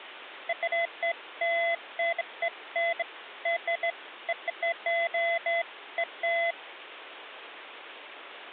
Beeps of irregular length. There is no code.